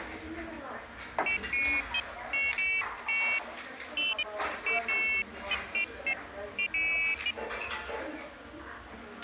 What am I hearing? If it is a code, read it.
Pairs of high tones at irregular times, with a squelch burst at the end and the noise of a cafe. There is no code.